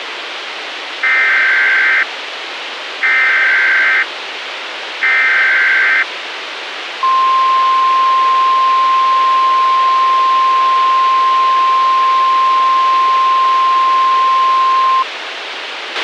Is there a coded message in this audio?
Yes: Emergency Alert System (SAME) tones (header bursts, then the 1050 Hz attention tone) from 1.0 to 15.0 s, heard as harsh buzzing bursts, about 520.83 baud, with radio hiss and a squelch burst at the end.